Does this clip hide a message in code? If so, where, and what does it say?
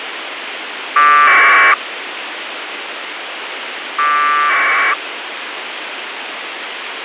Yes: packet radio (AX.25, as in APRS), 1200 baud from 1.0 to 4.9 s, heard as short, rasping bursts, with radio hiss.